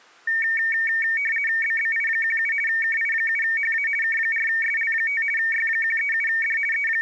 RTTY (50 baud, 450 Hz shift), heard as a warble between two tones, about 2050 Hz centre. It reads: BBI17 KI7HA K4SL5 Y137D …